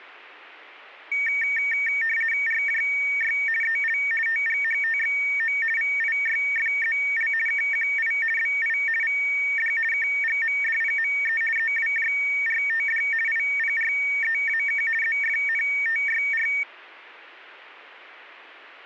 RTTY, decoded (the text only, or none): RJY EL TGHTXO VIYFZL KQI BI VD KGMDPME EWJRTD IPREAK ZFNTYR